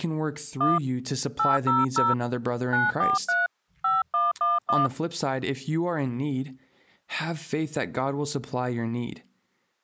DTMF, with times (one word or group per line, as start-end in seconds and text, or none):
0.6-0.8 1
1.4-2.1 800
2.7-3.5 943
3.8-4.9 5111